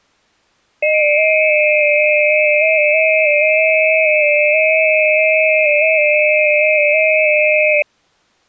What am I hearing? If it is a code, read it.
FT8 (several signals at once), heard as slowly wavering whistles, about 6.25 baud.